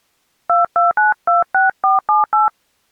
DTMF, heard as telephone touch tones, dialled by hand, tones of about 150 ms. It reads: 22926478